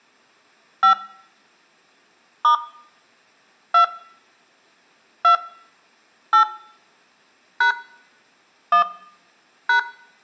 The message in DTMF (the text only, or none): 5 * 2 2 8 # 1 #